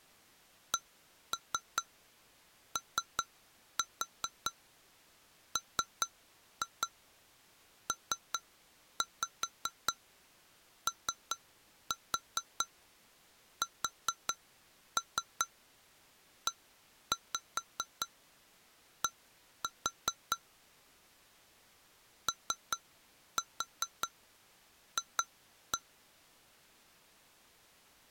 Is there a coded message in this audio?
Yes: tap code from 0.7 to 25.8 s, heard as taps on glass, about 4 knocks a second. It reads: COMPOSED OF